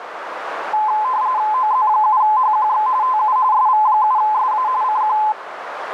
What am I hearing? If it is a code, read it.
RTTY (45.45 baud, 170 Hz shift), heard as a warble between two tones, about 940 Hz centre, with radio static and a narrow filter. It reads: OZ7HQX TU SV7SA CQ